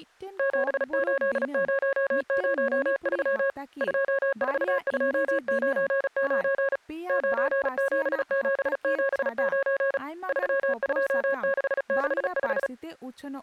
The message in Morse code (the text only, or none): 78003 24299 97779 32665